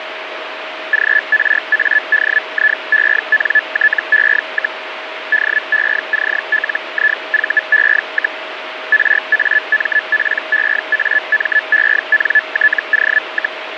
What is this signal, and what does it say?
Hellschreiber (Feld-Hell, 122.5 baud), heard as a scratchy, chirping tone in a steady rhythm, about 1750 Hz, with radio static and a steady whistle near 630 Hz. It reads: GRADIENTE, DECLIVE, RAMPEAMENTO,